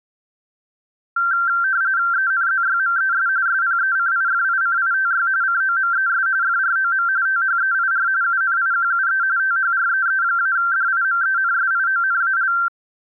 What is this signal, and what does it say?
RTTY (45.45 baud, 170 Hz shift), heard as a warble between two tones, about 1470 Hz centre. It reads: ENZYMES SPECIFICITY COMES FROM THEIR UNIQUE THREE-DIMENSIONAL